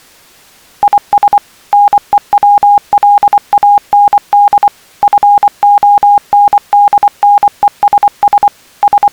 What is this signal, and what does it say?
Morse code, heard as a keyed tone, machine-sent, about 24 wpm, 820 Hz. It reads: IS NEWLAND FONDNESS …